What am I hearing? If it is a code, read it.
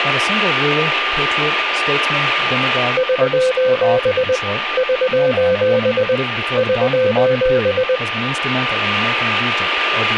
Morse code, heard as a keyed tone, machine-sent, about 20 wpm, 510 Hz, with radio static, a steady whistle near 1200 Hz and speech in English. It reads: <SOS> <SOS> <SOS>